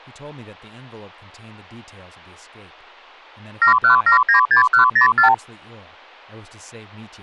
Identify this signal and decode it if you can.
Multi-frequency trunk signalling (R2, with the far end's replies), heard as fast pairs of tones, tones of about 110 ms, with speech in English. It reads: 71796104